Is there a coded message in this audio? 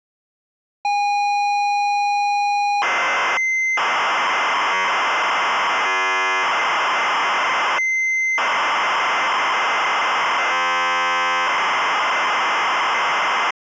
Yes: ZX Spectrum tape loading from 0.8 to 13.5 s, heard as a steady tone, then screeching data.